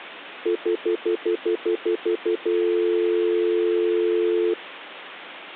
Telephone call progress tone (North American plan), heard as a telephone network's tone, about 350, 440 Hz, 0.1 s on and 0.1 s off. Stutter dial tone.